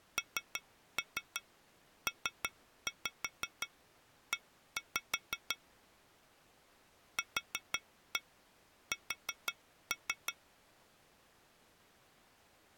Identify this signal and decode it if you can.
Tap code, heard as taps on glass, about 5 knocks a second. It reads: NPE QS